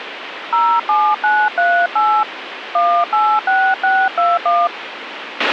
DTMF, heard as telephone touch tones, dialled by hand, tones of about 250 ms, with radio hiss and a squelch burst at the end. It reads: 07938 186621